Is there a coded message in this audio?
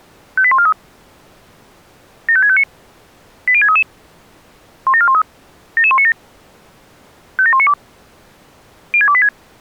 Yes: five-tone selective call (ZVEI) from 0.4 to 9.3 s, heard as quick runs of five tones, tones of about 70 ms. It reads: 58143 75659 80633 17413 77197 57192 06286